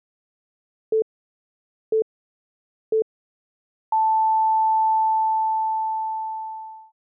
Radio time signal (three low pips and a long one an octave up, as on NHK), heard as pips.